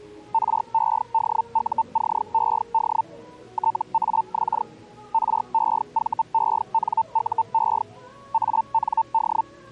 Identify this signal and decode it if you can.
Hellschreiber (Feld-Hell, 122.5 baud), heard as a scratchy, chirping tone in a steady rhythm, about 900 Hz, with the noise of a cafe. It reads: REDUCED TAX REVENUE AND